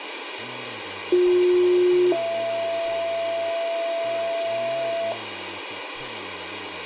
Two-tone page, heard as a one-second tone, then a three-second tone, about 360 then 670 Hz, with radio hiss and speech in English.